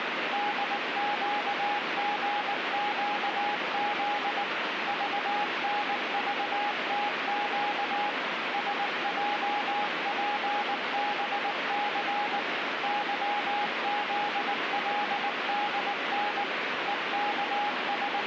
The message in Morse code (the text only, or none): DQGQZ VNVTQ SJPBC YZLDN …